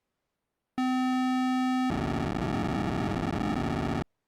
POCSAG pager data (512 baud), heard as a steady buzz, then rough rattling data.